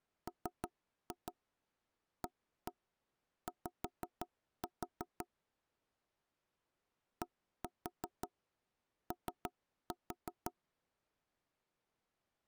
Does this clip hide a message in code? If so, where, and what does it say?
Yes: tap code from 0.3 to 10.5 s, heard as knocks on wood, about 5 knocks a second. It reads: MAY DO